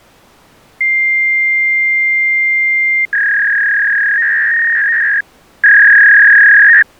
Fax machine handshake, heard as a long tone and a warble.